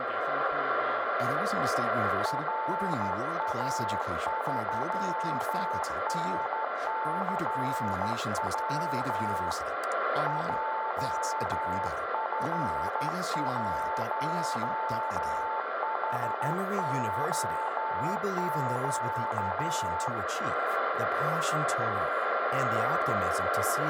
Morse code, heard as a keyed tone, hand-sent with a straight key, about 12 wpm, 880 Hz, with radio static, a steady whistle near 1370 Hz and room echo. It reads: RA3NCW JF1HOQ